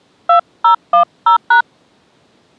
DTMF, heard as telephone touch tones, dialled by hand, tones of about 100 ms. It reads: 2010#